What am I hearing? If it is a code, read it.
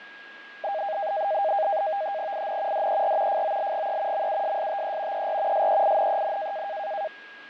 NAVTEX (SITOR-B), 100 baud, 170 Hz shift, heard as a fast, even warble, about 720 Hz centre, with fading and a steady whistle near 1640 Hz. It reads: IN DER FOLGE MUSSTE ER SEINEN